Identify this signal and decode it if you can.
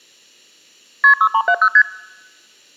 Multi-frequency trunk signalling (R1, as on North American trunks), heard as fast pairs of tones, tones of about 70 ms. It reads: KP 6370 ST